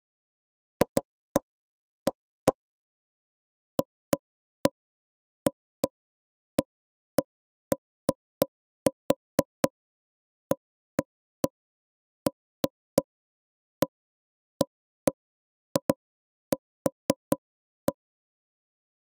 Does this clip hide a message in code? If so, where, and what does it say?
No, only irregular knocks on wood.